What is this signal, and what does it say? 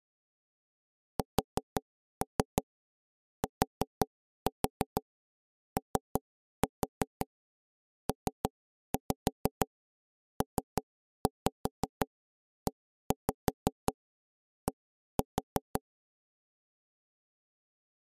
Tap code, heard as knocks on wood, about 5 knocks a second. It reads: STOPPED